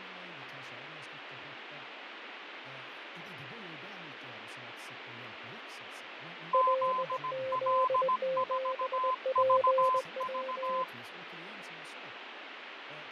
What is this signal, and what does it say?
Morse code, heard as two keyed tones, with radio static, fading and speech in Swedish. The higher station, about 17 wpm, 1020 Hz: ZL4VV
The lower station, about 20 wpm, 520 Hz: LZ7PW